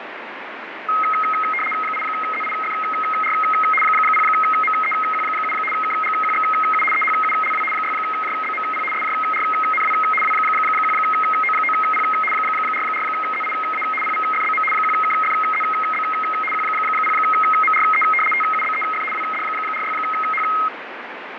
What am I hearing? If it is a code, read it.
RTTY (75 baud, 850 Hz shift), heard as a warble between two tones, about 1700 Hz centre, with radio static. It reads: 8ZIFR 0MEQ7 KGQXU EHULW 6JBMP SJRNW W1O9P 44ZIA PVFBM 1KFZB Q0MRE TUBEF WD46H